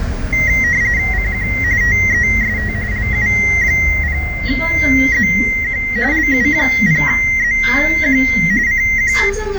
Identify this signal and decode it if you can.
RTTY (45.45 baud, 170 Hz shift), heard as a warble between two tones, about 2000 Hz centre, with radio static and the noise inside a bus. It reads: CQ TEST LU0ZQ LU0ZQ CQ